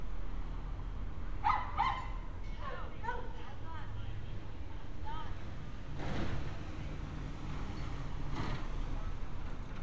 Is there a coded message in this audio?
No, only street noise.